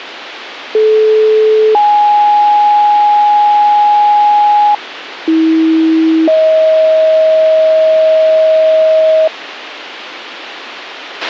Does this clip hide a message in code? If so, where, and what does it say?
Yes: two-tone page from 0.7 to 9.3 s, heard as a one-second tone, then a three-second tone, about 430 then 830 Hz, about 320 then 630 Hz, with radio hiss and a squelch burst at the end.